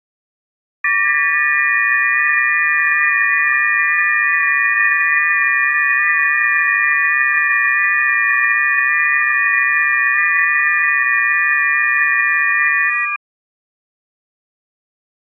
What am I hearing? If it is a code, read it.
FT8 (several signals at once), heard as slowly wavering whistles, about 6.25 baud.